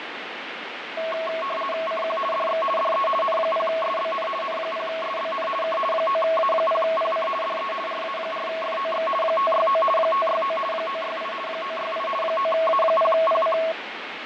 RTTY (50 baud, 450 Hz shift), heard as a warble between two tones, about 870 Hz centre, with radio static and fading. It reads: CQ DX DE N0SBN N0SBN K 9A0PC DE RA4FOX 569 569 968 968 9A0PC